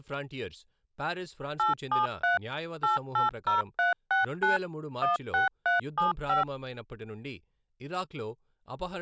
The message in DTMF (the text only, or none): 873 880369 16375